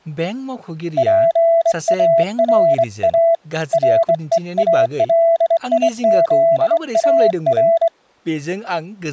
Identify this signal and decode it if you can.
Morse code, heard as a keyed tone, hand-sent with a straight key, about 23 wpm, 670 Hz, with speech in Bodo. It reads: PARA REALIZAR